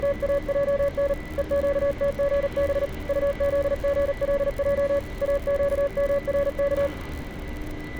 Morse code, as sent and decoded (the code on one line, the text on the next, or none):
… / . --.- - --. -... / ..- --.. --. .-.. .--- / .- --.- -- .-. -.-
… EQTGB UZGLJ AQMRK